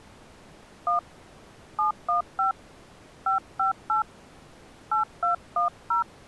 DTMF, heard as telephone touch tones, dialled by hand, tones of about 120 ms. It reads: 1 715 558 8210